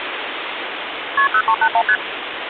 Multi-frequency trunk signalling (R1, as on North American trunks), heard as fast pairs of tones, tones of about 70 ms, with phone line noise. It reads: KP 0381 ST